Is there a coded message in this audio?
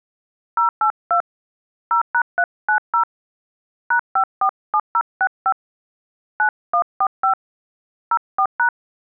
Yes: DTMF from 0.6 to 8.7 s, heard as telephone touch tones, dialled by hand, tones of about 90 ms. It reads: 082 0#390 #547065 9145 04#